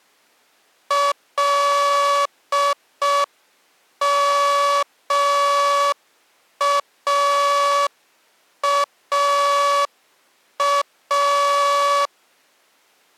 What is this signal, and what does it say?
Morse code, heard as a buzzer, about 5 wpm. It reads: LMAAA